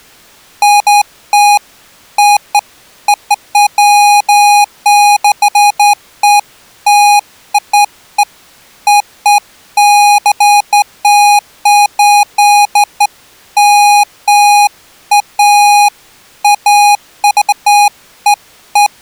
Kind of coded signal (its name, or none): none